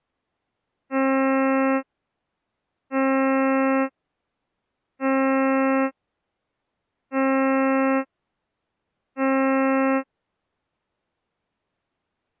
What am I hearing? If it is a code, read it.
Ship horn signal, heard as a ship's horn, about 270 Hz. 5 short. At sea: I doubt that you are doing enough to avoid a collision.